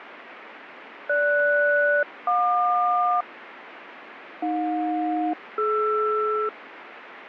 Aircraft SELCAL, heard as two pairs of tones, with radio static. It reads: GS-JQ AJ-DR